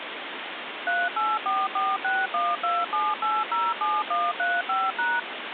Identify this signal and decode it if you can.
DTMF, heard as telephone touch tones, dialled by machine, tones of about 210 ms, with phone line noise. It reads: 38446127807135#